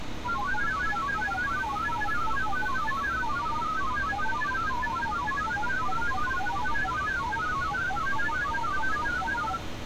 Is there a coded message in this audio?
Yes: multi-tone FSK (Olivia or MFSK type), about 1000 Hz wide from 0.2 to 9.6 s, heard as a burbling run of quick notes, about 31.25 baud, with street noise.